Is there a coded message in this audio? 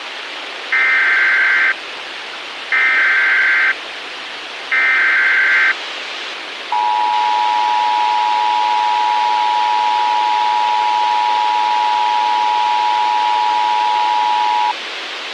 Yes: Emergency Alert System (SAME) tones (header bursts, then the 853 and 960 Hz attention tone) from 0.7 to 14.7 s, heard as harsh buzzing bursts, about 520.83 baud, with radio hiss.